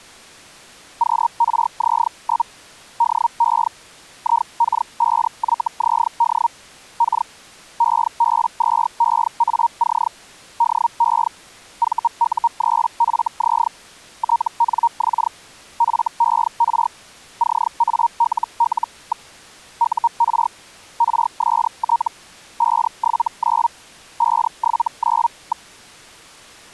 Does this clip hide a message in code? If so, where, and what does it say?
Yes: Hellschreiber (Feld-Hell, 122.5 baud) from 1.0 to 25.7 s, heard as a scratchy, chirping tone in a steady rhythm, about 940 Hz. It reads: QRZ? DE IK5YZD K EB2EAC DE VU3FZ TNX FER CALL. UR RST 579 579.